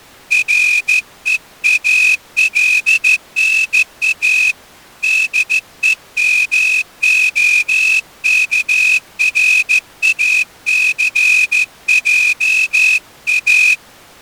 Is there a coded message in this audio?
Yes: Morse code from 0.3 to 13.8 s, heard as a whistle, hand-sent with a straight key, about 14 wpm. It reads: REALNA DEMOKRACJA